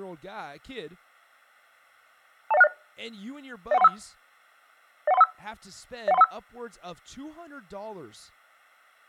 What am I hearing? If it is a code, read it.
Five-tone selective call (EIA), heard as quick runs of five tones, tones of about 30 ms, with speech in English. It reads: 20160 01315 01315 01315